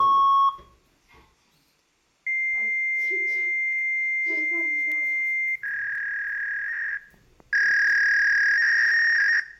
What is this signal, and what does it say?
Fax machine handshake, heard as a beep, a long tone and a warble, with room echo and the noise inside a lift.